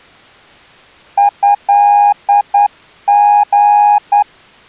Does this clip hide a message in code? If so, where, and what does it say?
Yes: Morse code (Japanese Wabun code) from 1.1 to 4.3 s, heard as a keyed tone, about 10 wpm, 820 Hz. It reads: トリ